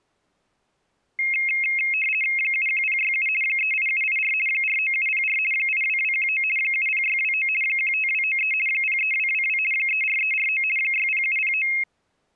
RTTY (50 baud, 450 Hz shift), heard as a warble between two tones, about 2350 Hz centre. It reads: 71067 38784 49704 82219 70629 15293 03222 34349 60709